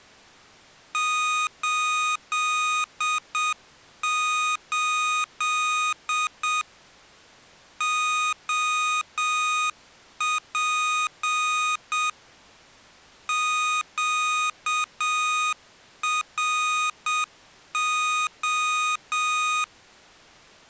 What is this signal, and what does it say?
Morse code, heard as electronic beeps, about 7 wpm, 1240 Hz. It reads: 88 OP QRO